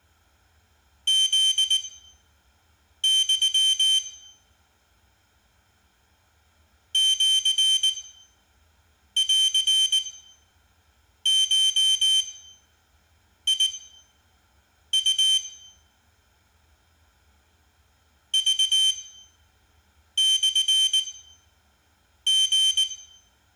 Morse code (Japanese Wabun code), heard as a high beeper, machine-sent, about 19 wpm, spaced as for 6 wpm, 3100 Hz, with room echo. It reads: フユ シンゴウ クモリ